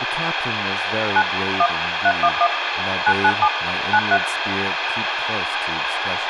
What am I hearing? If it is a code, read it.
DTMF, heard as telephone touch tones, dialled by machine, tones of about 60 ms, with radio hiss and speech in English. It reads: 9 1 311 997 93